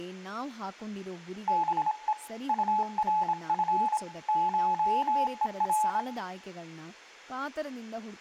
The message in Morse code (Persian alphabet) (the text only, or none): به طرف شهر